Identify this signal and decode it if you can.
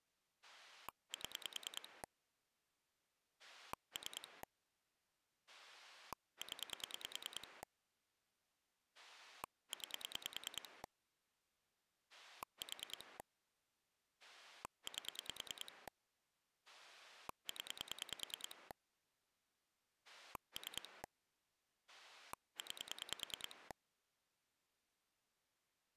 Pulse dialling, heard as a rotary dial, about 10 pulses a second. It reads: 7 3 0 9 4 8 0 3 9